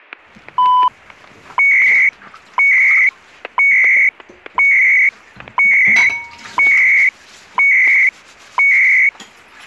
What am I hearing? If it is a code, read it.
Radio time signal (CHU, Canada), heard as beeps and data bursts, one a second, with static crashes and kitchen noise.